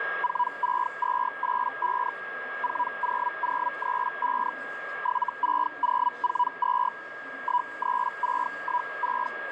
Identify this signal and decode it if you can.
Hellschreiber (Feld-Hell, 122.5 baud), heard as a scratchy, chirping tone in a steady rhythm, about 980 Hz, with radio static, a steady whistle near 1630 Hz and the noise of a crowd indoors. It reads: 46285 40035 76042 13616